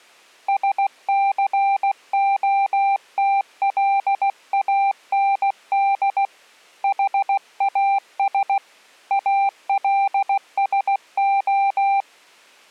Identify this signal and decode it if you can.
Morse code, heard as a keyed tone, hand-sent with a paddle, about 16 wpm, 790 Hz. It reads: SCOTLAND HAS ALSO